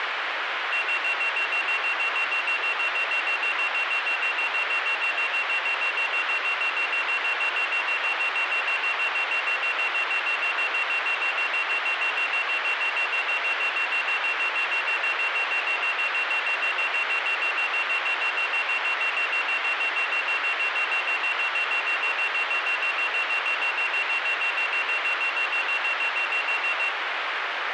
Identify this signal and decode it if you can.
Evenly repeated beeps, with radio hiss. There is no code.